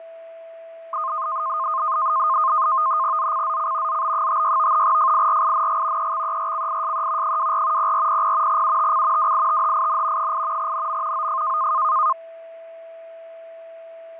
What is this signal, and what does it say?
NAVTEX (SITOR-B), 100 baud, 170 Hz shift, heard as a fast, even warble, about 1140 Hz centre, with fading and a steady whistle near 660 Hz. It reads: ZCZC ZB56 FIRING EXERCISE 24 0400 UTC WITHIN 8 NM OF